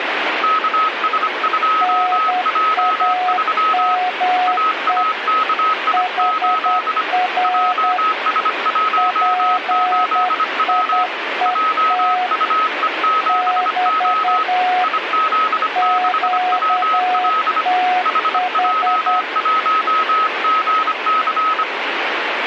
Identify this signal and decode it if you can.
Morse code, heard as two keyed tones, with radio static. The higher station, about 25 wpm, 1280 Hz: KS2J3 AAKI8 JS18W JUE7O IZ6WL HJ1GC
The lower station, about 10 wpm, 730 Hz: NAME HR PIET <BT> QTH